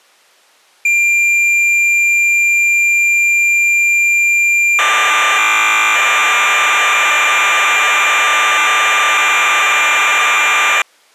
Cassette data (Kansas City type), 1200 baud, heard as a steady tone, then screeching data.